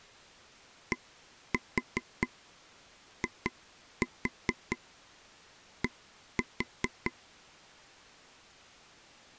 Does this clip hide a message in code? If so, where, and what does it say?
Yes: tap code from 0.9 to 7.1 s, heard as taps on a table, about 4 knocks a second. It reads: DID